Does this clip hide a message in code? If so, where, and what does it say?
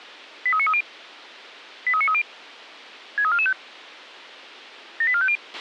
Yes: five-tone selective call (ZVEI) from 0.5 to 5.4 s, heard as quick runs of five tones, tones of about 70 ms, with a squelch burst at the end. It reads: 83930 83930 63445 78450